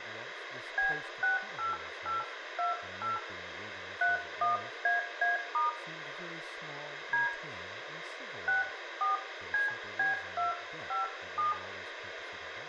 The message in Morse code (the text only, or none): none